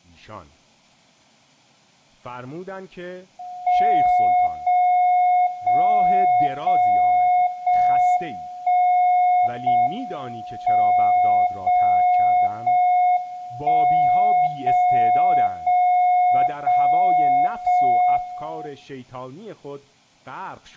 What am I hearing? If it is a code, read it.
Radio time signal (JJY), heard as a tone whose level steps once a second, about 720 Hz, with room echo and speech in Persian. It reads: 0 0 0 0 1 0 M 0 0 1 0 0 0 0 1